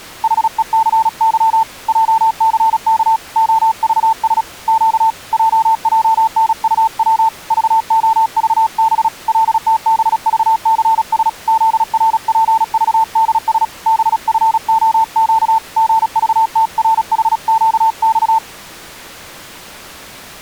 Morse code, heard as a keyed tone, hand-sent with a paddle, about 36 wpm, 890 Hz. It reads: HECY JCK OVS Q JJNUW VOVB LTBVCS ZRPVDS BFOQ GVTRHQX